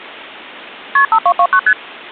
Multi-frequency trunk signalling (R1, as on North American trunks), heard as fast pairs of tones, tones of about 70 ms. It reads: KP 5229 ST